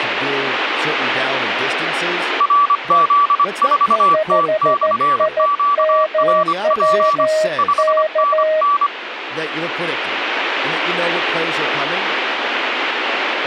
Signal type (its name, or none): Morse code